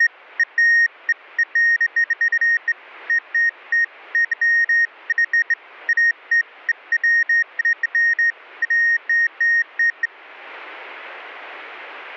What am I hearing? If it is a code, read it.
Beeps of irregular length. There is no code.